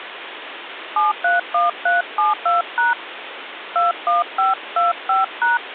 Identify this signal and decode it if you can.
DTMF, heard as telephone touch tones, dialled by hand, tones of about 160 ms, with phone line noise. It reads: 731372# 21525#